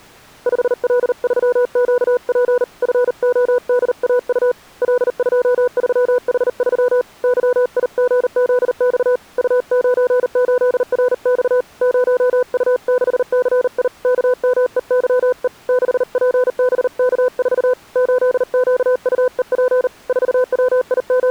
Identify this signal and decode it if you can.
Morse code, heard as a keyed tone, hand-sent with a paddle, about 39 wpm, 500 Hz. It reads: 5L3QP FODAU L23H3 YIGZX U98RX 0U6CI KMEYE 6PBK4 8QUEP …